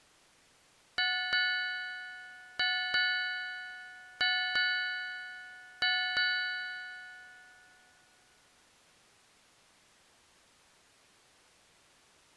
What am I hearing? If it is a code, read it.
Ship's bell, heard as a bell. 8. Eight half-hours of the watch have passed.